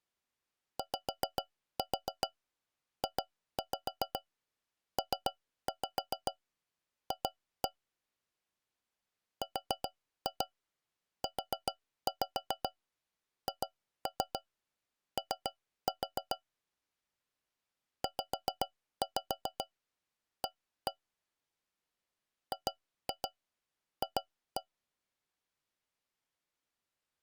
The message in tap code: YJPF RUHO ZA GF

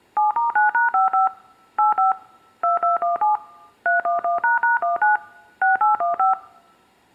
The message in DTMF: 7*9#55 85 2217 311##19 6815

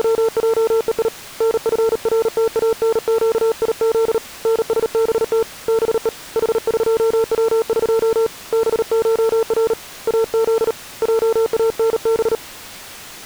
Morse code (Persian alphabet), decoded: … نفرتانگیز نسبت به حقوق بشر از جانب

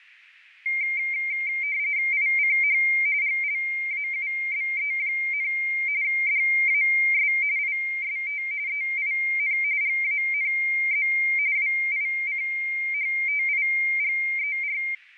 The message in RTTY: ICH GLAUBE, DAS IST EIN GANZ WICHTIGER

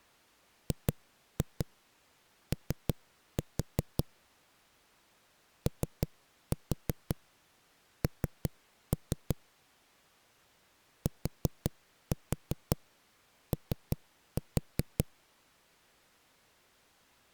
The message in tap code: GO ON TO

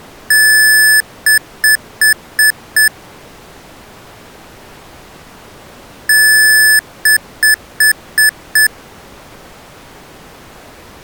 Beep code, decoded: 1 long, 5 short

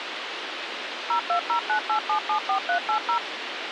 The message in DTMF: 02098774380

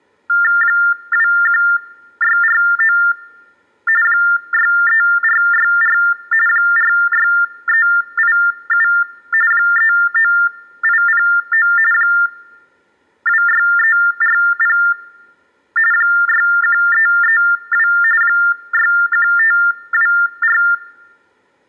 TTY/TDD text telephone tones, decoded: 21649 63464 46387 39809 26340 61332 61524

